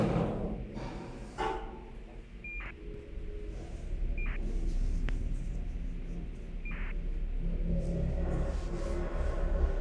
ACARS aircraft data, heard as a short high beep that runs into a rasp, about 2400 baud, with radio hiss and the noise inside a lift.